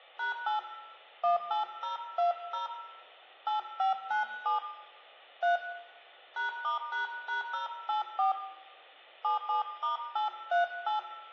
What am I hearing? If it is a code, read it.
DTMF, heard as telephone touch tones, dialled by hand, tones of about 130 ms, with room echo. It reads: #8 18020 8597 3 #*##084 77*838